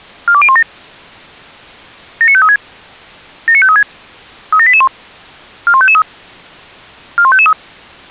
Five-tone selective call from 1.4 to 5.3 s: 79536 79536 37881

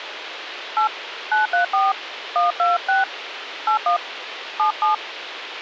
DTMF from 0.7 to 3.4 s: 8 934 126

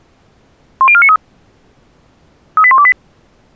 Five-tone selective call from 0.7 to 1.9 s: 10493

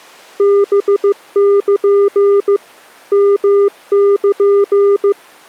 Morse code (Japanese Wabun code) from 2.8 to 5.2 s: ヨル

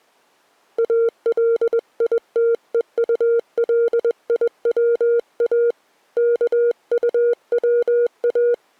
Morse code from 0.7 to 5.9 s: ALITEULIWA

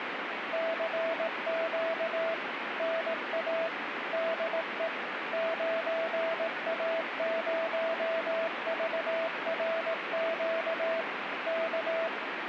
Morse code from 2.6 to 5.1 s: NA DE

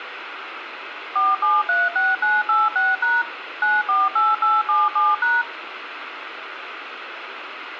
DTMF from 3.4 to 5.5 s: 948877#

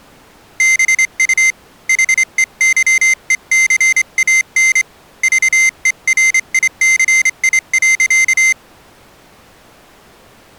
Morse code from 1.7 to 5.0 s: HEYECAN

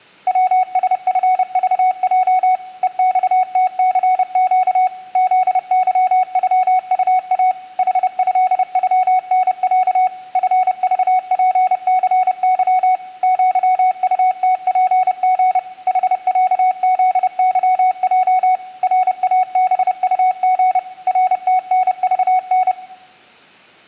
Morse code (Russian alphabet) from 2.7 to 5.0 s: ЕЬТЦЩ

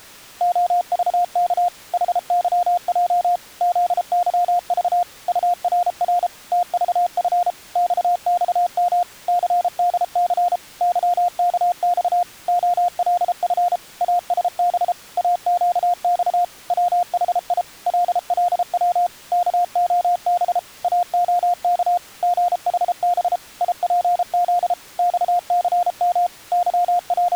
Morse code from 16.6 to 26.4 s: WHI LLW KOB AOK GHB IPZ XCM

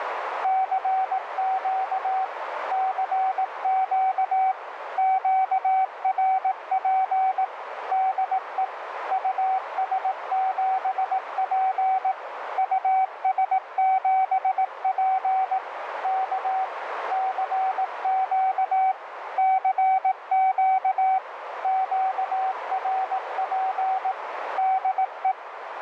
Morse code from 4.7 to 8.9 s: QRP DE

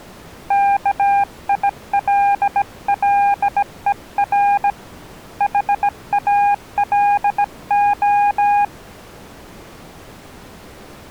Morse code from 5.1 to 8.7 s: HALO

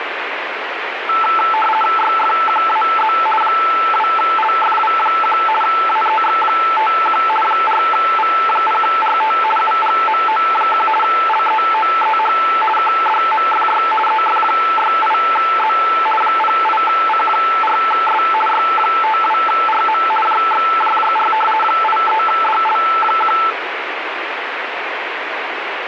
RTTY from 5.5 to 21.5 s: AEX51 4V0RT UGMO1 LEOEH KDMFY EF68Z 08C4S Y52RM JXJJR

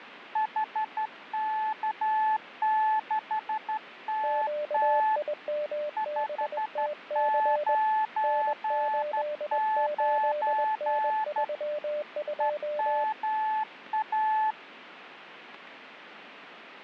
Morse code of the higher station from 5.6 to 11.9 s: 599

